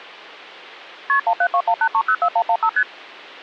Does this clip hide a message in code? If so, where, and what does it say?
Yes: multi-frequency trunk signalling (R1, as on North American trunks) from 1.1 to 2.8 s, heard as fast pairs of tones, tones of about 70 ms. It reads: KP 17218304115 ST